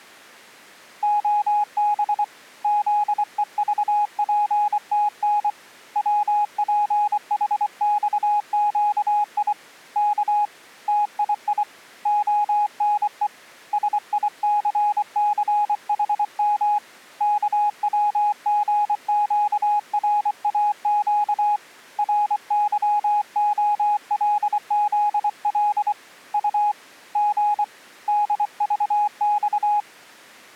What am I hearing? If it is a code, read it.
Morse code, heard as a keyed tone, hand-sent with a paddle, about 24 wpm, 830 Hz. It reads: OB ZEVPTN WPHXQI K TII ONE SICCHM KWGQRAQ RYOLZL U G DVX